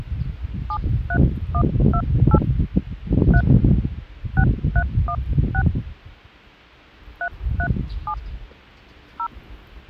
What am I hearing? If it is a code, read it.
DTMF, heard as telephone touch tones, dialled by hand, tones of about 70 ms, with the noise of a residential street. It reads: 73128 3 6316 337 0